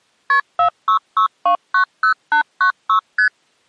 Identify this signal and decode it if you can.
Multi-frequency trunk signalling (R1, as on North American trunks), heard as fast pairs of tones, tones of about 100 ms. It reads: KP 466290896 ST